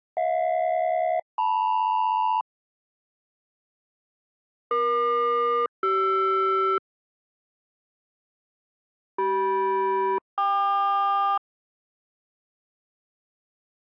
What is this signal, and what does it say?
Aircraft SELCAL, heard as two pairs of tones. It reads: HJ-LM EQ-CR CM-KQ